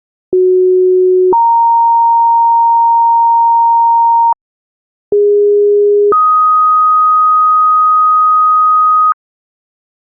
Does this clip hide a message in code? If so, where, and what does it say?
Yes: two-tone page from 0.3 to 9.1 s, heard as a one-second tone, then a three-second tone, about 370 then 930 Hz, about 410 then 1250 Hz.